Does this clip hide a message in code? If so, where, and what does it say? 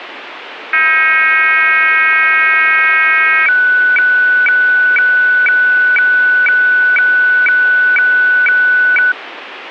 Yes: weather fax (radiofax), 120 lines a minute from 0.7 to 9.1 s, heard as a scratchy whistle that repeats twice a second, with radio static.